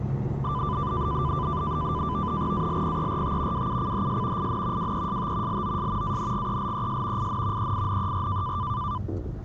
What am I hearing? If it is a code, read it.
NAVTEX (SITOR-B), 100 baud, 170 Hz shift, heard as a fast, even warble, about 1090 Hz centre, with the noise inside a car. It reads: ALPERT WUCHS IN WEST LOS ANGELES IN EINER